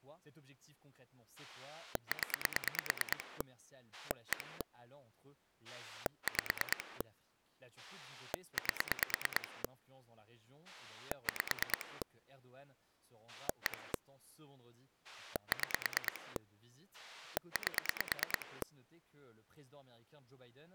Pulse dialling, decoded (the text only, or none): 0 1 5 8 5 1 6 8